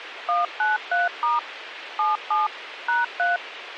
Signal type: DTMF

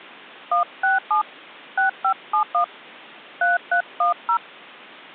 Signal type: DTMF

